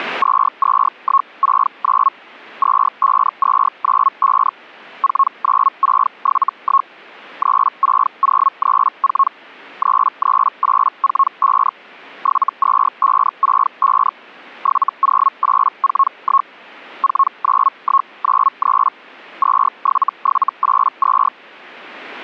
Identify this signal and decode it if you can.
Hellschreiber (Feld-Hell, 122.5 baud), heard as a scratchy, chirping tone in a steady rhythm, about 1090 Hz. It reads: 22169 25295 49671 36034 33845 72565 70841 49193 27782